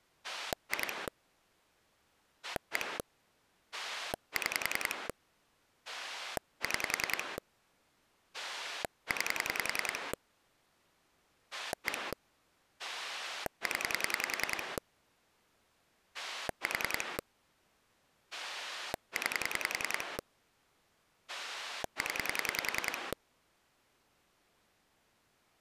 Pulse dialling, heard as a rotary dial, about 10 pulses a second. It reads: 2 1 6 6 9 1 0 4 9 0